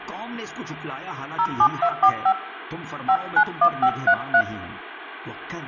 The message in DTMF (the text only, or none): 07245 591533